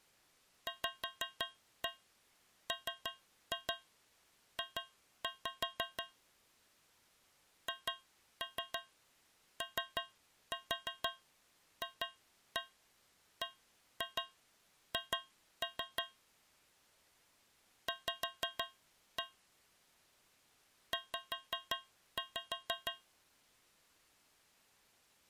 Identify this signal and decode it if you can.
Tap code, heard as taps on a metal pipe, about 6 knocks a second. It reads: VMJ HOFBH V Z